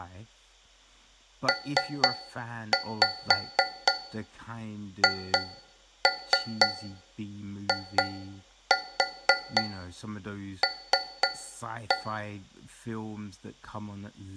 Tap code, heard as taps on a metal pipe, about 4 knocks a second, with speech in English. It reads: PHIL